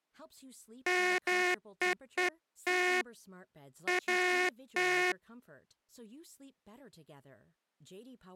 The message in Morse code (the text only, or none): MEET AT